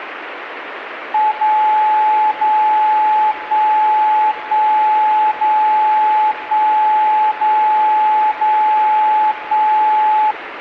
Radio time signal (DCF77), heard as a tone whose level steps once a second, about 860 Hz, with radio static. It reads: 0 0 1 1 0 1 0 0 1